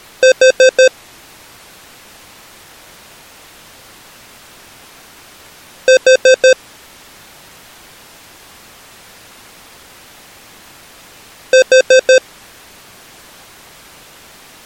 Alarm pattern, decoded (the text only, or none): temporal four